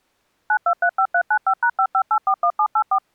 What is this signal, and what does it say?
DTMF, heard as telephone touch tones, dialled by machine, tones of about 70 ms. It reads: 9235395#55841784